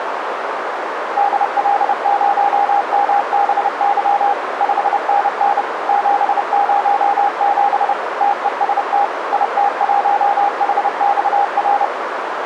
Morse code, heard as a keyed tone, machine-sent, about 30 wpm, 810 Hz, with radio static and a narrow filter. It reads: DL0MBY 5NN 707 TEST IT1HXR